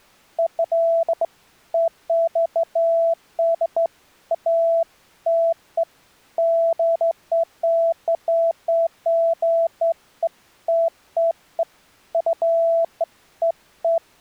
Beeps of irregular length. There is no code.